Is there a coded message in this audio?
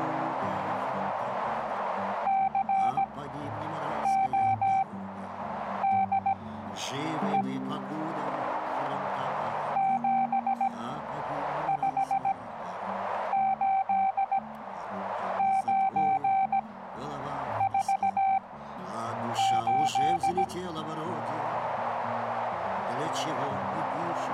Yes: Morse code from 2.2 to 20.5 s, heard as a keyed tone, machine-sent, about 17 wpm, spaced as for 7 wpm, 770 Hz, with radio static and a narrow filter. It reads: CODE 758948